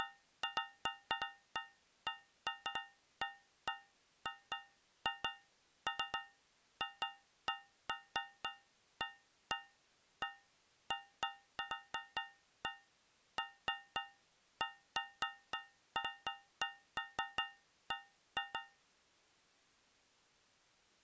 Irregular taps on a metal pipe. There is no code.